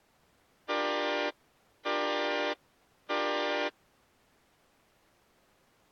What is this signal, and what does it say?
Train horn signal, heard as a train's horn. 3 short. On North American railways: when stopped, the train will back up.